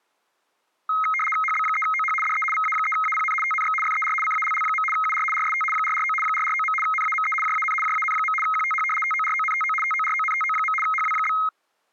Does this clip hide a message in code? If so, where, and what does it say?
Yes: RTTY (75 baud, 850 Hz shift) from 0.9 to 11.5 s, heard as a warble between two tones, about 1700 Hz centre. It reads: HB3OH DE VA3APN TNX FER CALL. UR RST 449 449. NAME JAN JAN. QTH TORONTO TORONTO. HW?